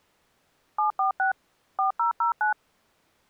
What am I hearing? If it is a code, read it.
DTMF, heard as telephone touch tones, dialled by machine, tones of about 120 ms. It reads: 746 4009